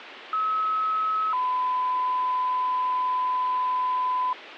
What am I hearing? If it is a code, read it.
Two-tone page, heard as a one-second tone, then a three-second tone, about 1290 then 1010 Hz, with radio hiss.